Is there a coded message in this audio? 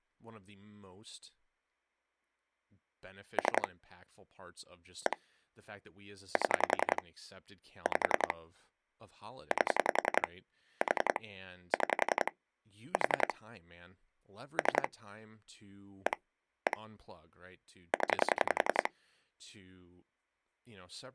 Yes: pulse dialling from 3.4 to 18.9 s, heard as clicks on a phone line, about 11 pulses a second, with speech in English. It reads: 3 1 7 5 8 4 6 4 3 1 1 0